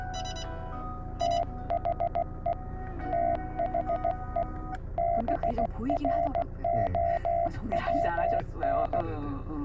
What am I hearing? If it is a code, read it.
Morse code, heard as a keyed tone, hand-sent with a paddle, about 16 wpm, 680 Hz, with the noise inside a car. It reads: THE THE BROWN